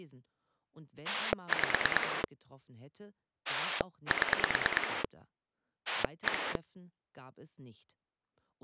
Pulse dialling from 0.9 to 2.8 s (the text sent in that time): 5